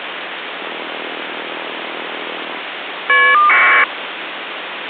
Caller ID data burst, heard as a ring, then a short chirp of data, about 1200 baud, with phone line noise.